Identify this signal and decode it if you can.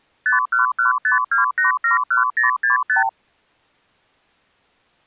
Multi-frequency trunk signalling (R2, with the far end's replies), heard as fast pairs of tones, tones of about 130 ms. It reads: 51152871065